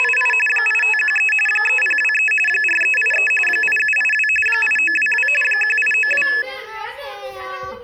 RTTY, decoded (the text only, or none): … 8513 3023 4383 8782 8922 1892